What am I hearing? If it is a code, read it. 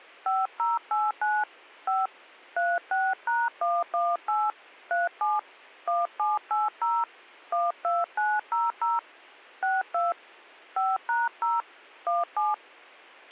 DTMF, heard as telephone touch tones, dialled by hand, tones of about 190 ms, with a squelch burst at the end. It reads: 5089 5 36#118 37 1780 12900 62 5#0 17